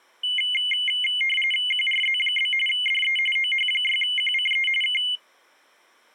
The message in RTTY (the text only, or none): QRZ? DE OH6QCE K